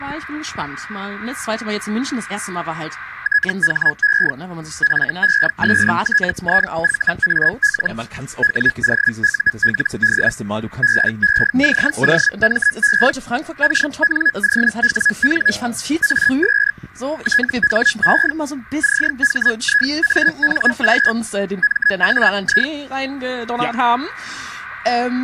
Hellschreiber (Feld-Hell, 122.5 baud), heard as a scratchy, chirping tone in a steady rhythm, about 1700 Hz, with static crashes. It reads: THE FESTIVAL WOULD BECOME KNOWN AS THE CHIANG MAI